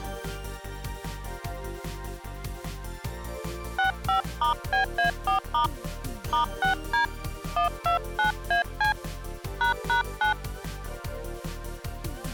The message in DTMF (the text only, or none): 65*BA4* *6D 129AC ##9